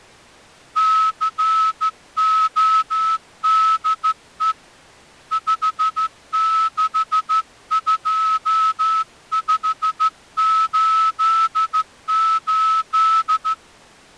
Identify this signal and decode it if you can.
Morse code, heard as a whistle, hand-sent with a straight key, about 14 wpm. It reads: CODE 562588